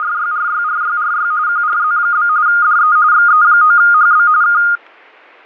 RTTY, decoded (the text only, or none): … QRZ? DE XE9HB K